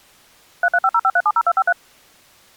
DTMF, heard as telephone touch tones, dialled by machine, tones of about 50 ms. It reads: 33505370253